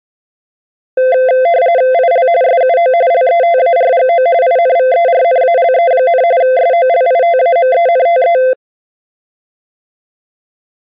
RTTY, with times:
1.9-2.3 IL
2.4-2.9 SUO
3.1-4.3 LETARGO
4.4-6.2 INVERNALE,
6.4-8.4 SOLITAMENTE

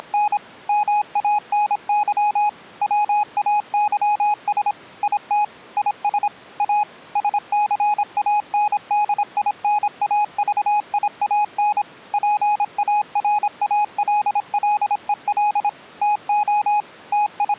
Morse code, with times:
0.0-0.4 …
0.7-2.5 MANY
2.8-4.7 WAYS
5.0-5.4 IT
5.8-6.3 IS
6.6-6.8 A
7.2-11.8 SCANDINAVIAN
12.1-15.7 PARALLEL
16.0-16.8 TO
17.1-17.6 …

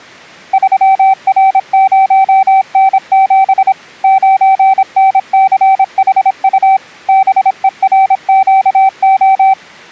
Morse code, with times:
0.5-3.7 3R0N7
4.0-6.8 9NCHU
7.1-9.5 BERQO

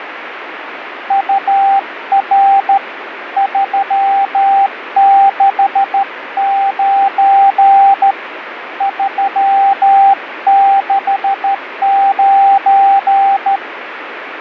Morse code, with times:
1.1-2.8 UR
3.4-8.1 369
8.8-13.6 369

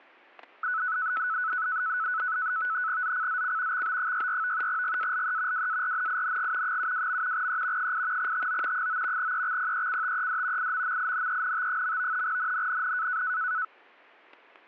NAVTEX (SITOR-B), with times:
3.0-3.8 ZCZC
3.7-4.7 XB64
4.7-5.7 GALE
5.5-6.8 WARNING
6.6-7.5 72.
7.3-7.9 E
7.8-8.3 8
8.2-8.9 TO
8.7-9.3 9
9.2-10.7 EXPECTED
10.6-12.2 IMMINENT.
12.2-13.2 NNNN

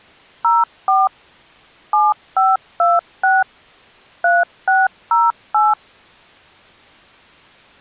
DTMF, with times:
0.4-1.1 04
1.9-3.4 7526
4.2-5.7 3608

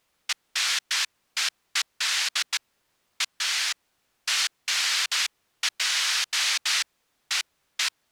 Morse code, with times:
none

